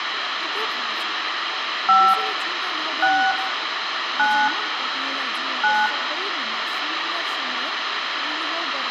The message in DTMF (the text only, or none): 5 6 9 9